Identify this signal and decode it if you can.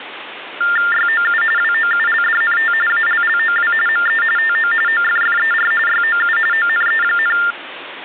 TTY/TDD text telephone tones (45.45 baud Baudot), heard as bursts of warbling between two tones, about 400 Hz shift, 1600 Hz centre, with phone line noise. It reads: YOU WOULDNT ALLOW ME TO OFFER YOU ONE,